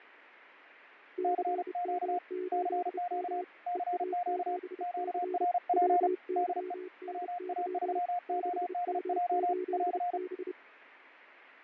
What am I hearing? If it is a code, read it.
Morse code, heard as two keyed tones, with fading. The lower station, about 30 wpm, 370 Hz: CM8M EA7C WYNY 6M8B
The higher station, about 35 wpm, 710 Hz: CQ CQ CQ QRP DE WA3ODJ <AR>